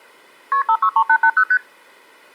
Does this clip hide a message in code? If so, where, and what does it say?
Yes: multi-frequency trunk signalling (R1, as on North American trunks) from 0.5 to 1.6 s, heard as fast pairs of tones, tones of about 70 ms. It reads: KP 563880 ST